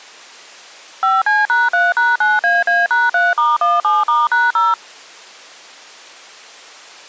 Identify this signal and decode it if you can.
DTMF, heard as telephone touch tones, dialled by machine, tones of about 190 ms. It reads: 5C#3#9AA#3*17*#0